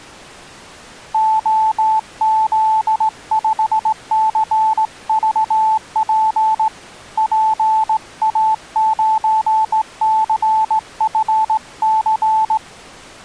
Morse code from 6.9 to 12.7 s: PA9CFC

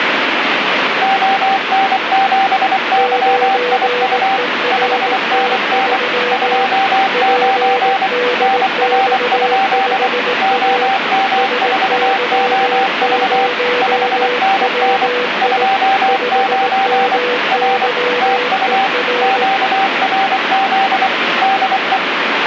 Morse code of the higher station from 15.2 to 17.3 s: 29

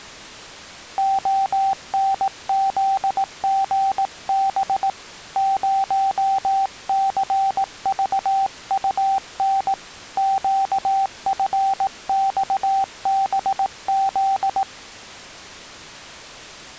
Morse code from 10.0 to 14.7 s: QFXBZ

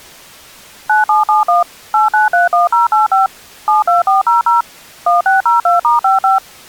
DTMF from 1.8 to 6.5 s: 8931085 72400 1602*55

